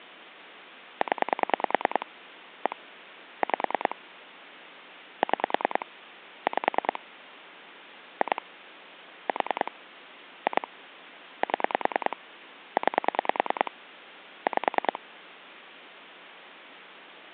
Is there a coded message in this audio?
Yes: pulse dialling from 1.0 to 15.0 s, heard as clicks on a phone line, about 10 pulses a second. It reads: 0 1 5 6 5 2 4 2 7 9 5